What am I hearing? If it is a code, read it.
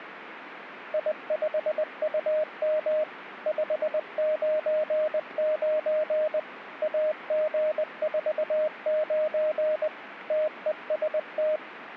Morse code, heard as a keyed tone, machine-sent, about 20 wpm, 620 Hz, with radio static. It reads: I5UM 599 AG49 TEST